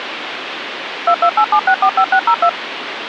DTMF, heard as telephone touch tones, dialled by machine, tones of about 70 ms, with phone line noise. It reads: 2287645602